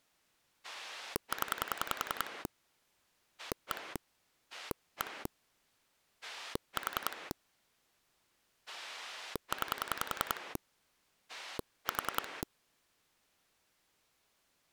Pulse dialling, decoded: 0 1 1 4 9 4

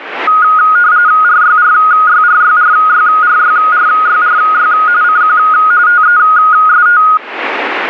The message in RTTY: RYRYRYRYRYRYRY CQ TEST

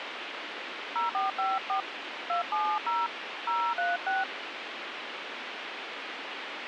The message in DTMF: 0454 270 036

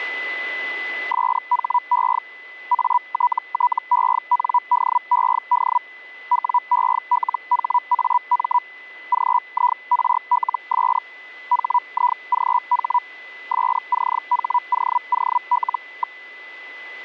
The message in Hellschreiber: SHE ATTENDED WELHAM GIRLS HIGH SCHOOL.

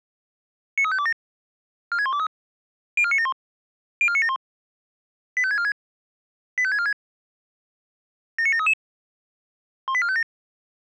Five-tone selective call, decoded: 93527 46123 04971 04971 85646 85646 79733 18457

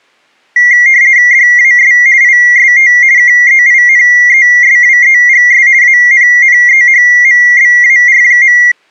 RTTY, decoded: DAS IST KEINESWEGS ANNEHMBAR.

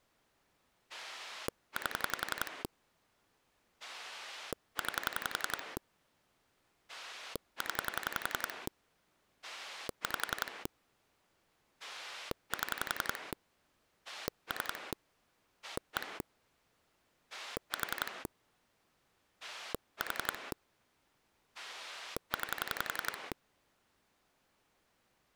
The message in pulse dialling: 8 9 0 5 7 3 1 4 4 9

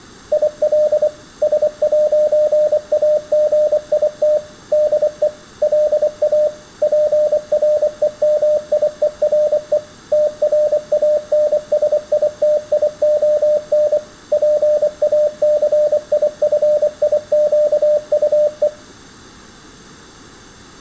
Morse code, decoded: IL S'AGIT DE LA PREMIERE TRANSITION PACIFIQUE

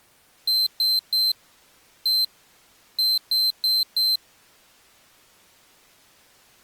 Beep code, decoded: 3-1-4

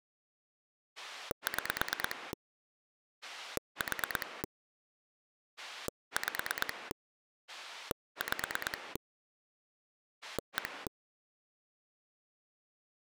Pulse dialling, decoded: 6 4 5 5 1

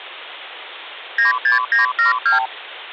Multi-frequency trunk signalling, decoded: 96972

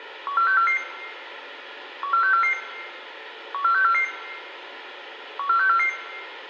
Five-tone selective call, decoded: 14644 14644 14644 14644

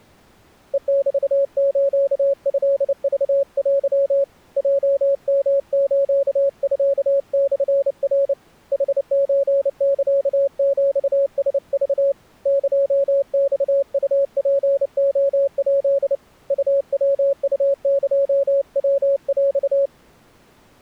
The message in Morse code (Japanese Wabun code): ヘメストクテ ヲヨスミモナ ヌソサヒラク エマウツレヱ ウヤウエヤヰ

